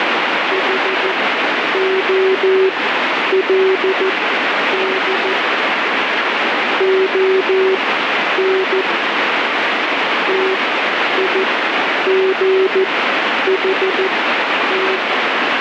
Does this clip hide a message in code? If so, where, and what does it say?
Yes: Morse code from 0.5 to 15.0 s, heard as a keyed tone, machine-sent, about 14 wpm, spaced as for 9 wpm, 380 Hz, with heavy radio static. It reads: HOLD ON TIGHT